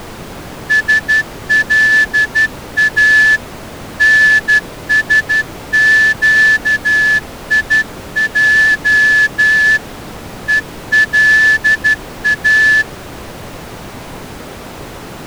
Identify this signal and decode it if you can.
Morse code (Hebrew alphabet), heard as a whistle, hand-sent with a straight key, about 12 wpm. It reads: שלא נשקיע ולא